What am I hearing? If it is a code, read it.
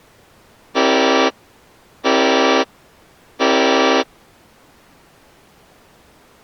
Train horn signal, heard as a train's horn. 3 short. On North American railways: when stopped, the train will back up.